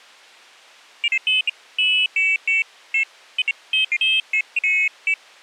Pairs of high tones at irregular times. There is no code.